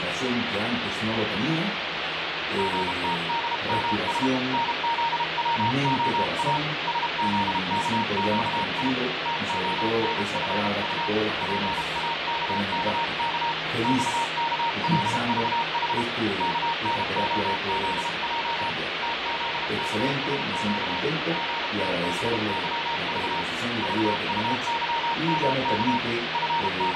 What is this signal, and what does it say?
Morse code, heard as a keyed tone, hand-sent with a paddle, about 32 wpm, 920 Hz, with heavy radio static and fading. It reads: GTDMS NZWOA SZKQI TONFU PAKKK XKLVH KNOZJ TZKSQ GTBYV VUYMK …